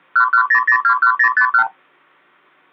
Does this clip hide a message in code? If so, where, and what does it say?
Yes: multi-frequency trunk signalling (R2, with the far end's replies) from 0.2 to 1.7 s, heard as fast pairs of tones, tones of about 90 ms, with hum. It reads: 110021051